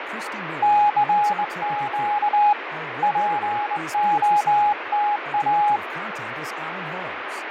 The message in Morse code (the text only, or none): CQ POTA